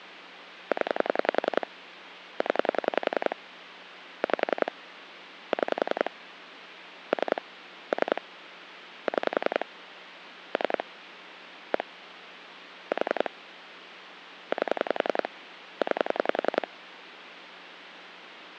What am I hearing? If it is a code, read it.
Pulse dialling, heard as clicks on a phone line, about 10 pulses a second, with phone line noise. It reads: 0 0 5 6 3 3 6 3 1 4 8 9